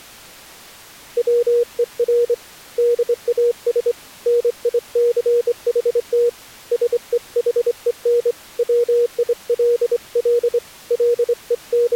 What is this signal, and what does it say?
Morse code, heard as a keyed tone, hand-sent with a straight key, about 25 wpm, 480 Hz. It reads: WER DAS NICHT SEHEN WILL …